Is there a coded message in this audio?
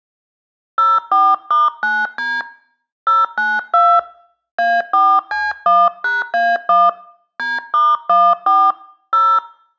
Yes: DTMF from 0.8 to 9.4 s, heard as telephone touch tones, dialled by hand, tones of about 220 ms. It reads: 04*9D 092 A4C1#A1 D*14 0